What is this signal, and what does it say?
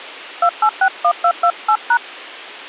DTMF, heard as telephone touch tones, dialled by hand, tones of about 70 ms. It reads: 2861228#